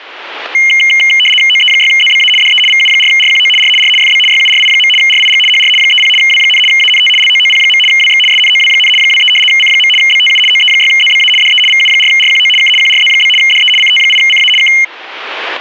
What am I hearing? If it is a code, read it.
RTTY (75 baud, 850 Hz shift), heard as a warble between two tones, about 2550 Hz centre. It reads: OE6ZBA DE VU4RQO R R FB YURI. RIG HR 30 W, ANT LOOP. WX SNOW, 23 C. BTU OE6ZBA DE VU4RQO K QRZ? DE CT8CA K